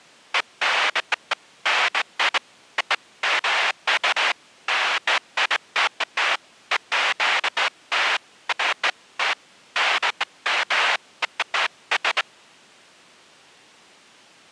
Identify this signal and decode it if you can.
Bursts of noise. There is no code.